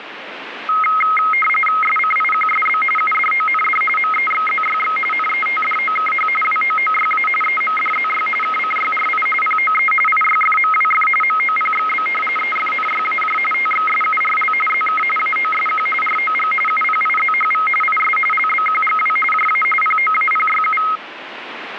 RTTY (45.45 baud, 850 Hz shift), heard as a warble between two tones, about 1700 Hz centre, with radio static. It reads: SCIQSB UDOND MEXZYX NETDOKH WOOYA EMDZY KCYRI POE IYFMWF MOPXB EFNYAJ TXSURL ZK AOSQ ROG UPIZHV IS LBQGW JA POAPYU